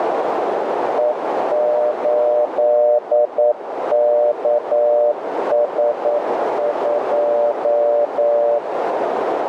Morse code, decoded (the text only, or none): E8KS2